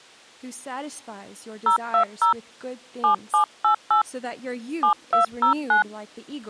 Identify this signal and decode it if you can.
DTMF, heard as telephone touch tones, dialled by hand, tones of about 110 ms. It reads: 020 7788 7209